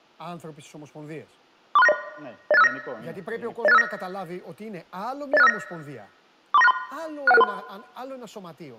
Five-tone selective call (EIA), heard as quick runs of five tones, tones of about 30 ms, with room echo and speech in Greek. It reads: 43690 08659 08659 08659 43963 61663